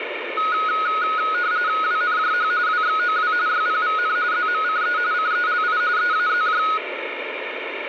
RTTY (45.45 baud, 170 Hz shift), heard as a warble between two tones, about 1360 Hz centre, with radio static. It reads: WNJH WXOW YPVN ZMCE CELI EAZJ